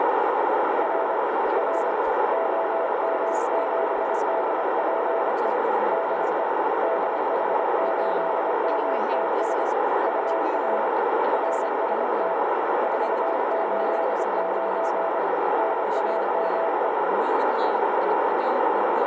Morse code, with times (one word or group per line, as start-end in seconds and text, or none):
0.8-1.2 R
1.6-1.9 R
2.3-5.5 OM7DPE
5.9-6.4 DE
6.8-9.6 DH8MTS
10.1-10.9 UR
11.3-12.3 RST
12.8-15.2 489
15.6-16.9 NAME